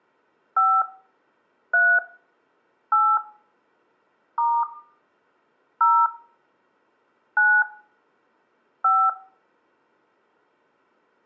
DTMF, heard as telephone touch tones, dialled by hand, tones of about 250 ms, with room echo. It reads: 5 3 8 * 0 9 5